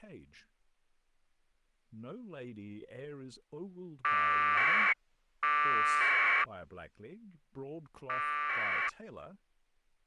Packet radio (AX.25, as in APRS), 1200 baud, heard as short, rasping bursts, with speech in English.